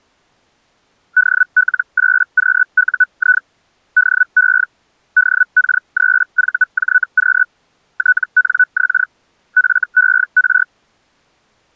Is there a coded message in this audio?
Yes: Hellschreiber (Feld-Hell, 122.5 baud) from 1.2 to 10.6 s, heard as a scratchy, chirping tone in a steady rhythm, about 1490 Hz. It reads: DL8QUI DE DK3VJQ TNX FER